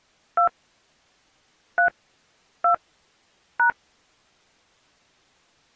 DTMF, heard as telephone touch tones, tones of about 100 ms. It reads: 2 3 2 #